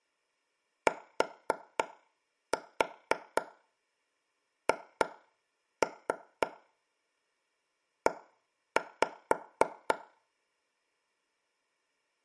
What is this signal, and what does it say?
Tap code, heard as taps on a table, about 4 knocks a second, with room echo. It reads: THE